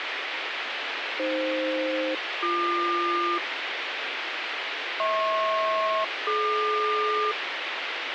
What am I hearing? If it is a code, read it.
Aircraft SELCAL, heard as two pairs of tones, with radio hiss. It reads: AF-BQ HP-DQ